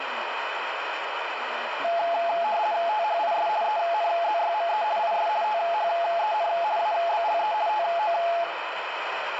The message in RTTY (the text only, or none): THIS ENZYME IS THEN ABLE TO